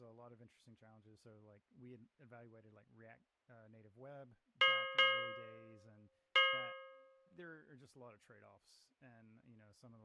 Ship's bell, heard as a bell, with speech in English. 3. Three half-hours of the watch have passed.